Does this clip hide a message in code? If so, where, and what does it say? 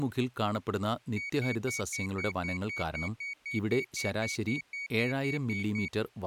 No, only evenly repeated beeps, with speech in Malayalam.